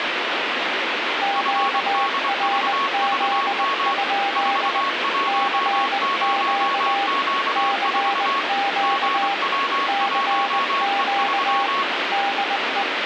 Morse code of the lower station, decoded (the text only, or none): QRZ? CQ CQ CQ DE